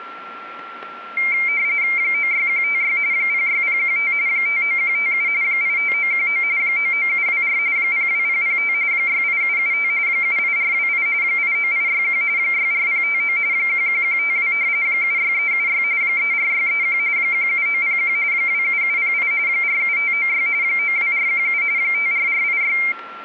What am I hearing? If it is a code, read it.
RTTY (45.45 baud, 170 Hz shift), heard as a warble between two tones, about 2200 Hz centre, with a steady whistle near 1360 Hz. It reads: 96156 06015 59157 85919 99724 02005 68775 78428 89861 64059 11152 76376 34631 17901 27708 47596 92417 54486